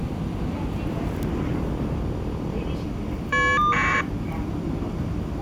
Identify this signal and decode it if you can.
Caller ID data burst, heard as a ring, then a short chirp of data, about 1200 baud, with the noise inside a subway train.